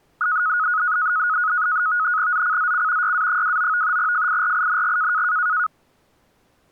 NAVTEX (SITOR-B), 100 baud, 170 Hz shift, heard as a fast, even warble, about 1360 Hz centre. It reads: ZCZC YA29 FIRING